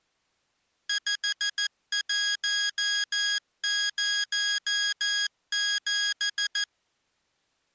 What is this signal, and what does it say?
Morse code, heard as electronic beeps, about 14 wpm, 1650 Hz. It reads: 5107